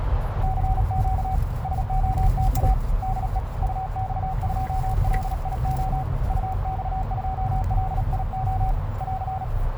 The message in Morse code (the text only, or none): CQ SOTA DE UX2LIO UX2LIO <AR>